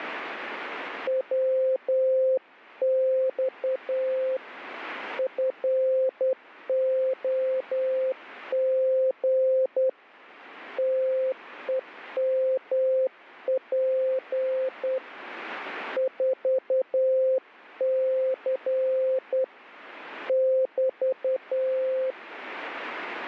Morse code, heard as a keyed tone, hand-sent with a straight key, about 10 wpm, 520 Hz. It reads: WX FOG TEMP 4C <BT>